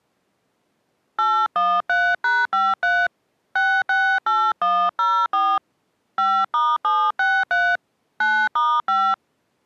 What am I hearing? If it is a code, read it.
DTMF, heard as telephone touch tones, dialled by hand, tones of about 250 ms. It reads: 813#53 668104 5*763 9*5